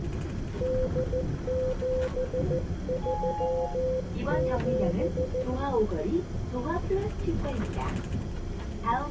Morse code (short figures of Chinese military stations), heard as a keyed tone, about 14 wpm, 510 Hz, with room echo and the noise inside a bus. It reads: 8737